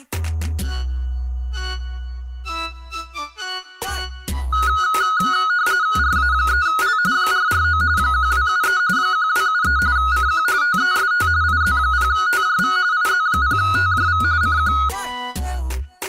RTTY (45.45 baud, 170 Hz shift), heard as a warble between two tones, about 1360 Hz centre. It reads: RA3L 449 1273 1273 CQ TEST IZ0TJV IZ0TJV CQ